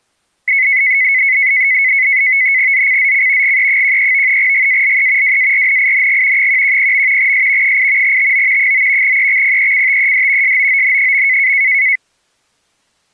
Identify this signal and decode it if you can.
NAVTEX (SITOR-B), 100 baud, 170 Hz shift, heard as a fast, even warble, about 2100 Hz centre. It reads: ZCZC GE13 GALE WARNING 110. S 8 TO 9 EXPECTED SOON.